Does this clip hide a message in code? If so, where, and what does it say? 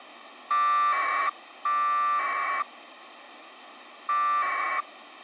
Yes: packet radio (AX.25, as in APRS), 1200 baud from 0.5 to 4.8 s, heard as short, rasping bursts, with radio hiss.